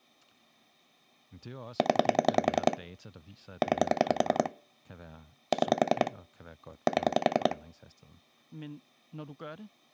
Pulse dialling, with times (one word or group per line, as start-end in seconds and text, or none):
1.8-2.8 0
3.6-4.5 9
5.5-6.1 6
6.9-7.6 7